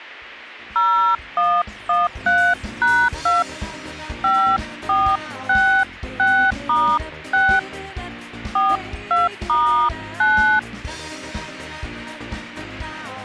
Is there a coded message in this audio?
Yes: DTMF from 0.8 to 10.6 s, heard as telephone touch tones, dialled by hand, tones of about 280 ms, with a squelch burst at the end. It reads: 0113#2 5466*6 42*9